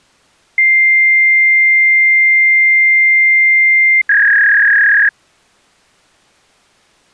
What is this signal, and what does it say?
Fax machine handshake, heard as a long tone and a warble.